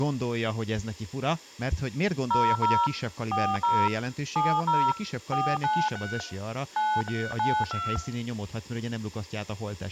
DTMF, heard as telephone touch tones, dialled by machine, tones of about 250 ms, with speech in Hungarian. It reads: 00 40 70 493 9392